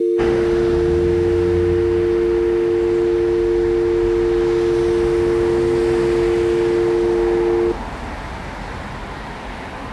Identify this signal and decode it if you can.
Telephone call progress tone (North American or UK plan), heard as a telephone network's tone, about 350, 450 Hz, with street noise. Dial tone.